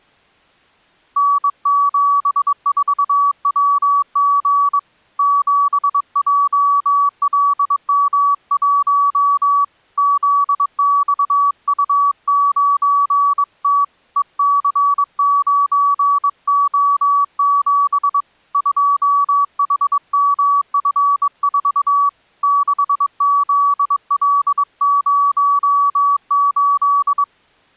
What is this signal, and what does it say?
Morse code, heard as a keyed tone, hand-sent with a bug key, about 22 wpm, 1140 Hz. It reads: N74WG 7JLM1 ZXU9T EC9O7 2HMF4 6ZL08